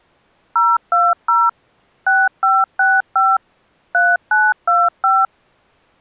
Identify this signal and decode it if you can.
DTMF, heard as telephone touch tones, dialled by machine, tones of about 210 ms. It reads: 020 6565 3925